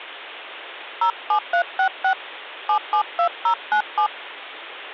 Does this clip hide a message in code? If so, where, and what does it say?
Yes: DTMF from 1.0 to 4.1 s, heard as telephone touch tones, dialled by hand, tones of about 90 ms. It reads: 07366 772097